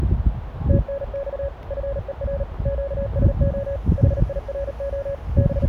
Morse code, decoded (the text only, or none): TNX FER QSO HIRO …